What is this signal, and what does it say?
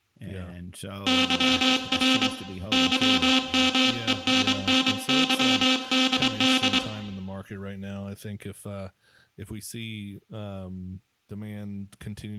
Morse code, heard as a buzzer, hand-sent with a straight key, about 24 wpm, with room echo and speech in English. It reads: YR YMENNYDD